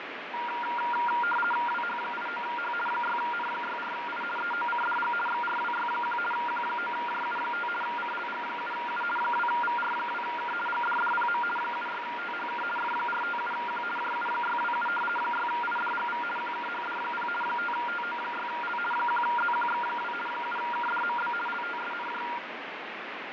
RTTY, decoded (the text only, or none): WH89H 6N64I EOCDG XRWY1 Q9JU5 CLG7U 2VR2K GDDPM 76THK F457Q JU627 6IDGV QKHD0 5TO6L 1ZQX2 7KDMB LTSNJ